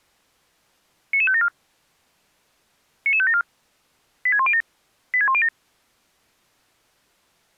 Five-tone selective call (ZVEI), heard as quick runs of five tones, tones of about 70 ms. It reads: 99574 99574 86107 86107